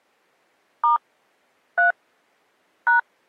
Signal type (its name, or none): DTMF